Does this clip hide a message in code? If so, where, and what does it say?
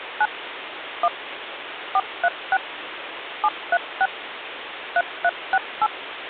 Yes: DTMF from 0.2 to 5.9 s, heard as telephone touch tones, dialled by machine, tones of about 50 ms, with phone line noise. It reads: 9 1 436 736 3368